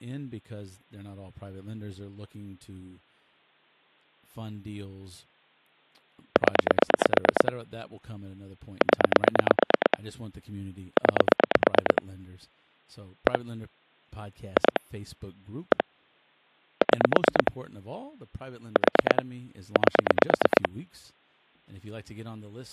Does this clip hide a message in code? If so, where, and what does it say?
Yes: pulse dialling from 6.4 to 20.7 s, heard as clicks on a phone line, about 9 pulses a second, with speech in English. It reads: 0 0 9 1 2 1 6 4 8